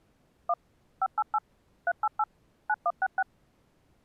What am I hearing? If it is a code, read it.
DTMF, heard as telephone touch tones, dialled by machine, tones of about 50 ms. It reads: 1 588 388 9166